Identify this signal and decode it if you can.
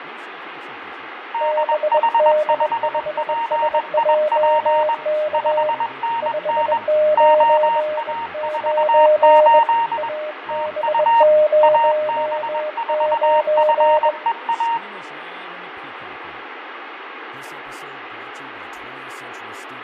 Morse code, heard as two keyed tones, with radio static, fading, room echo and speech in English. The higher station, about 21 wpm, 920 Hz: DH5PIP 5NN OA48 TU AB4FEA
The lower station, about 21 wpm, 610 Hz: BD5SJK 599 AB09